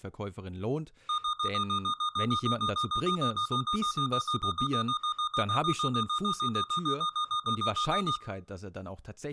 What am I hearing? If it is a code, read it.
Evenly repeated beeps, with room echo and speech in German. There is no code.